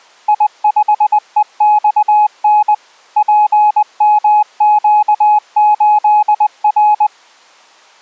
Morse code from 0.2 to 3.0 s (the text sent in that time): I5EXN